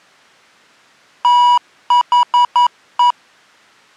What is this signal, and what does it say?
Morse code, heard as electronic beeps, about 11 wpm, 970 Hz. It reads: THE